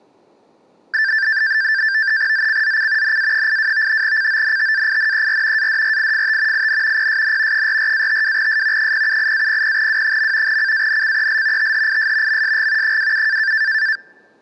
NAVTEX (SITOR-B), 100 baud, 170 Hz shift, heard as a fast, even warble, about 1650 Hz centre. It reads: ZCZC NA82 CONTAINER ADRIFT IN PSN 44-52S 078-00W. CANCEL THIS MSG 27